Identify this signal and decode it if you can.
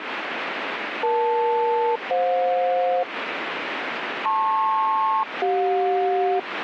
Aircraft SELCAL, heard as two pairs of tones, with radio static. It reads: EL-FJ LP-CJ